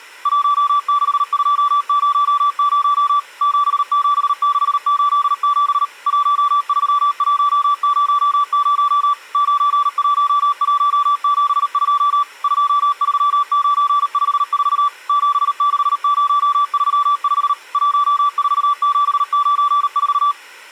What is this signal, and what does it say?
Morse code, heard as a keyed tone, machine-sent, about 38 wpm, 1160 Hz. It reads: 16200 77687 13100 91172 23954 76035 14794